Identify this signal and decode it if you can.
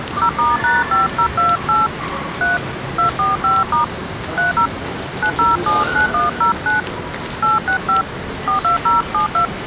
DTMF, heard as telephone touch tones, dialled by hand, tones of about 130 ms, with the noise of a subway station. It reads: 0*#5028 3 245* 30 9079109 865 42072